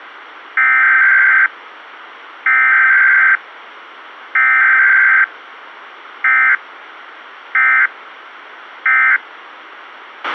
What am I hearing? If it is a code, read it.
Emergency Alert System (SAME) tones (header bursts, then end-of-message bursts), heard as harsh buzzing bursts, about 520.83 baud, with radio hiss and a squelch burst at the end.